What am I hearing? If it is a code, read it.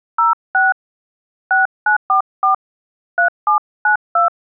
DTMF, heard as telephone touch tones, dialled by hand, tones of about 130 ms. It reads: 06 6944 3792